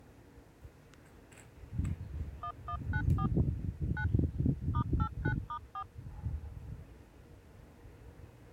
DTMF, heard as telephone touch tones, dialled by machine, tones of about 80 ms, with the noise of a residential street. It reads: 1194 9 *89*4